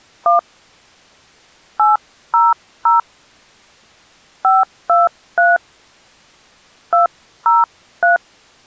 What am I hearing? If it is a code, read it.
DTMF, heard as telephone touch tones, dialled by hand, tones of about 170 ms. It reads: 1 800 523 203